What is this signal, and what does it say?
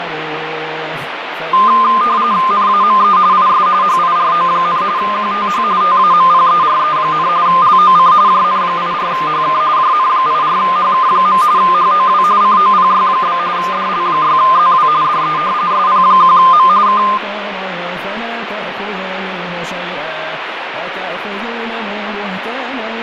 RTTY (45.45 baud, 170 Hz shift), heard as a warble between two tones, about 1130 Hz centre, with radio static and fading. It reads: NAME IS HIRO, QTH TAMPERE, LOC JN84HK JN84HK. HOW COPY? DL6ZW DE SP1M K